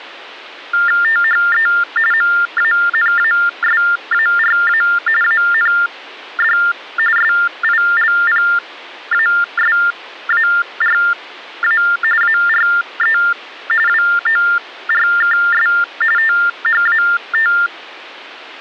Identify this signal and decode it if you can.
TTY/TDD text telephone tones (45.45 baud Baudot), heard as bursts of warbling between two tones, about 400 Hz shift, 1600 Hz centre. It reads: THE MANASARA AND SILPASARA ARE WORKS THAT